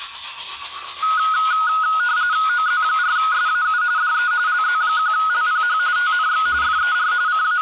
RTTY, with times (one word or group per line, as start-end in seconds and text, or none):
2.5-3.8 OZ4SAU
4.0-4.3 DE
4.5-5.8 LZ1LPH
6.0-6.5 TNX
6.6-7.1 FER
7.3-7.6 …